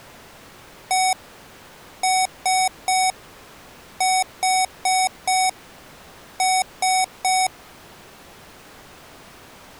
Beep code, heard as beeps from a small speaker, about 750 Hz. 1-3-4-3. In Phoenix BIOS tables: memory failure on data bits.